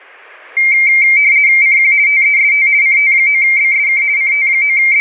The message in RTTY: CQ TEST CT9BSK …

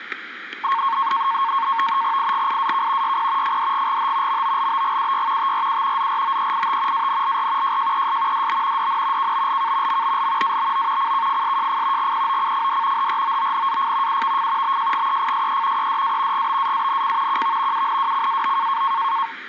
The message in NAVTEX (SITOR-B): IGIAK YP FDGGH MOLBGUY TRU ZROEIT ANLR JJES DB DN KBLK MBL ABO CKFSJF GPOCFD HROONAF UVF BJGEFSE EDA GBAANC QV UNWCAO

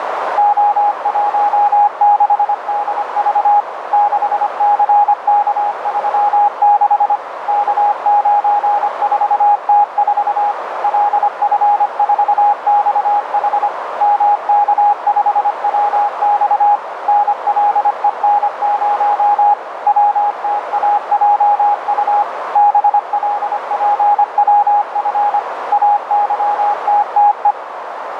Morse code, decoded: O16DV 6CK36 K94T4 LF4XH MK5WX NLEN0 WTAJU BLPWF AYTTE

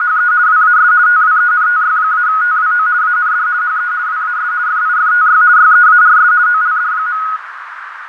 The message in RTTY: … WAS TWENTY-TWO AND HE WAS FIFTY YEARS OLD.

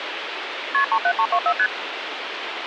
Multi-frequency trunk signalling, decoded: KP 37324 ST

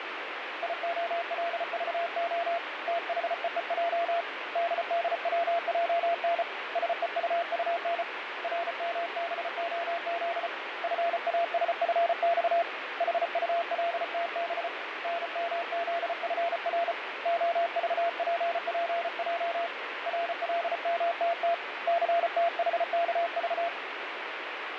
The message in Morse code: IOLVO THEEJ DDWJN SEUUN RMBOZ FASFX HULTB NMZFR OVPPJ RLMTT CTHKV

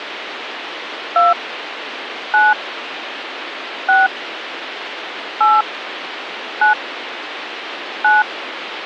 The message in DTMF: 2 9 6 8 9 9

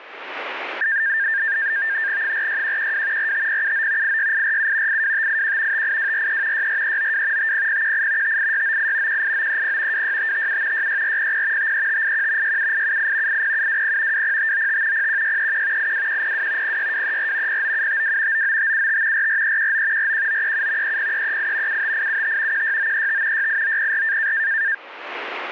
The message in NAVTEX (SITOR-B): 46112 45079 86847 82581 58243 64392 50018 58698 18930 26557 66400 53581 67878 80720 20595 01631 82102 06234 09752 99575 44319 41937 30338 75875 16935 68904

